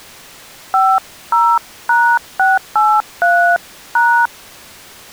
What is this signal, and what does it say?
DTMF, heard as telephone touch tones, dialled by hand, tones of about 270 ms. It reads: 50#683#